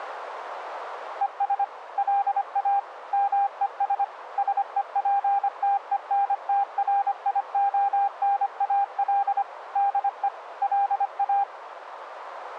Morse code, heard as a keyed tone, machine-sent, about 25 wpm, 800 Hz, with radio static. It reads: ES LA MES SEPTENTRIONAL DE LA